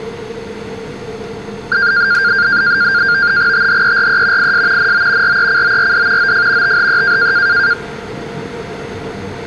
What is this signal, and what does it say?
NAVTEX (SITOR-B), 100 baud, 170 Hz shift, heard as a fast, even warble, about 1500 Hz centre, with the noise inside a subway train. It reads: THERE IS NO RECORD OF THE